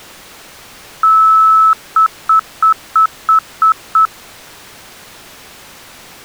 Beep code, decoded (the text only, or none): 1 long, 7 short